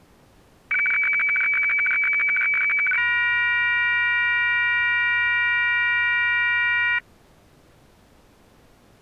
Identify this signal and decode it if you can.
Weather fax (radiofax), 120 lines a minute, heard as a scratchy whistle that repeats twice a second.